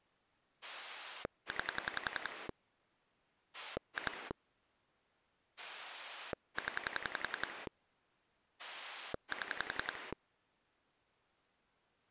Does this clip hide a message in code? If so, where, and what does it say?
Yes: pulse dialling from 0.6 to 10.1 s, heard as a rotary dial, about 11 pulses a second. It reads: 9 2 0 7